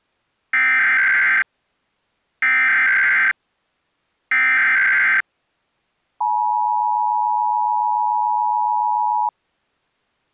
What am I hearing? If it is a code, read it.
Emergency Alert System (SAME) tones (header bursts, then the 853 and 960 Hz attention tone), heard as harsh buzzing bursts, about 520.83 baud.